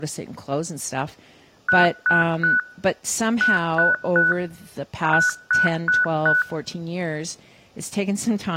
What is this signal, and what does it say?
Beep code, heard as beeps, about 1480 Hz, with speech in English. 3-3-4. In Phoenix BIOS tables: video failure.